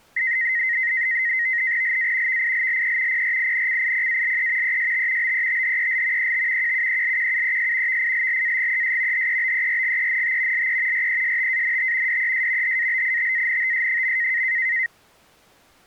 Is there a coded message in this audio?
Yes: NAVTEX (SITOR-B), 100 baud, 170 Hz shift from 0.2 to 14.9 s, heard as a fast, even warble, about 1950 Hz centre. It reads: LA VILLE PRINCIPALE EST BETHEL ET QUELQUES VILLAGES HEBERGENT LE RESTANT DES HABITANTS.